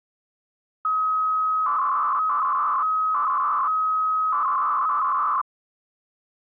300-baud modem data (Bell 103 tones), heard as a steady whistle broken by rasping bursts, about 300 baud, 200 Hz shift.